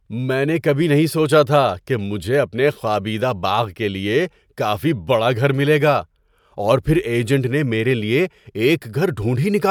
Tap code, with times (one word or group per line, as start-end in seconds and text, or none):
none